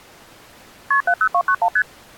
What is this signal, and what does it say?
Multi-frequency trunk signalling (R1, as on North American trunks), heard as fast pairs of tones, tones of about 70 ms. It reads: KP 70291 ST